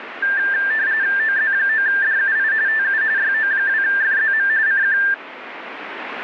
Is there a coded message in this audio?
Yes: RTTY (45.45 baud, 170 Hz shift) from 0.2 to 5.1 s, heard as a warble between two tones, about 1700 Hz centre, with radio static. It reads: OZ9DUI TU YO2FZM CQ